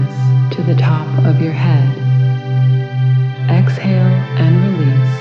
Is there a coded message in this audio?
No.